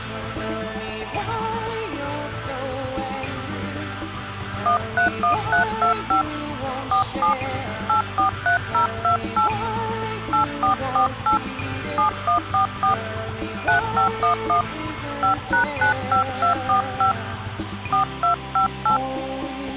DTMF, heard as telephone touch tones, dialled by hand, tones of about 110 ms. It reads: 131325 47 843028 8448 7144 3511 5#95245 4258